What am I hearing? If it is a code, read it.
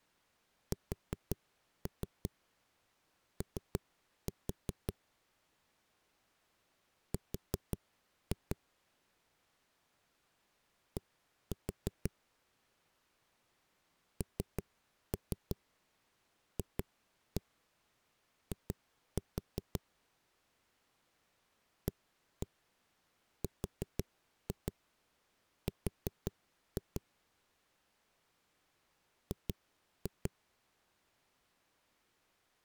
Tap code, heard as knocks on a wall, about 5 knocks a second. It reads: SO R D NFI ARR G